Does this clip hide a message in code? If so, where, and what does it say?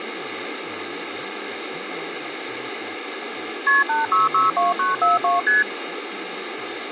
Yes: multi-frequency trunk signalling (R1, as on North American trunks) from 3.7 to 5.6 s, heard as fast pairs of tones, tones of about 160 ms, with phone line noise and speech in English. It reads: KP 8662942 ST